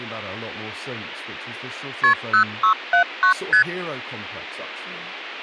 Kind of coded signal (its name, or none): multi-frequency trunk signalling